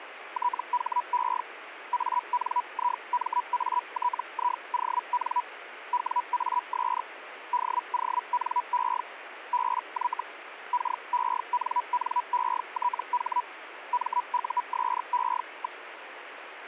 Hellschreiber (Feld-Hell, 122.5 baud), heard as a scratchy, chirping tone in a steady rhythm, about 980 Hz, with radio static. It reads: THE ANIMATION WAS DONE BY KENNETH MUSE.